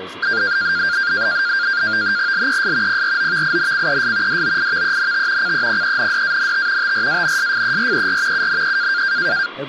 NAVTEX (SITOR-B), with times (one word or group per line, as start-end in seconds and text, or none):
2.3-3.0 LES
2.9-4.4 PROVINCES
4.3-5.5 DOIVENT
5.4-6.9 CEPENDANT
6.8-8.5 TRANSFERER
8.3-9.0 UNE